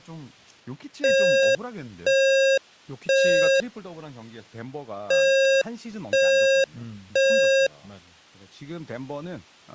Alarm pattern, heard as an alarm's beeps, played twice, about 540 Hz, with speech in Korean. Temporal three. Smoke or fire, evacuate.